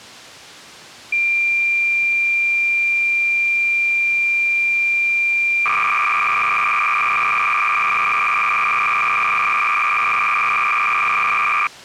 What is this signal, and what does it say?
Cassette data (Kansas City type), 300 baud, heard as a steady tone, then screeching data.